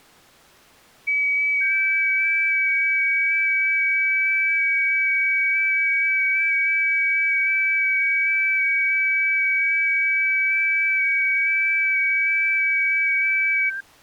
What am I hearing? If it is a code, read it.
FT8 (several signals at once), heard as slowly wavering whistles, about 6.25 baud.